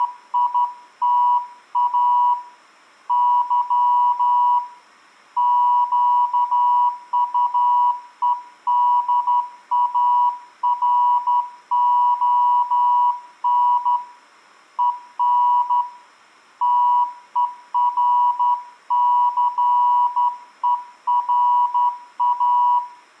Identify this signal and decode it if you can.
Morse code, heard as a keyed tone, hand-sent with a straight key, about 12 wpm, 980 Hz, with room echo. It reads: … Y QUEDARON EN TERCERA